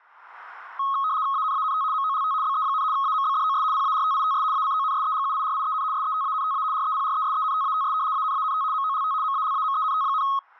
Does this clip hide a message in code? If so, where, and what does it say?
Yes: RTTY (75 baud, 170 Hz shift) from 0.8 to 10.4 s, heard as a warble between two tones, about 1180 Hz centre. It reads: ANANT MOLT BE, AMBDOS PARTITS ACONSEGUIRIEN SETANTA REPRESENTATS ANANT MOLT MALAMENT,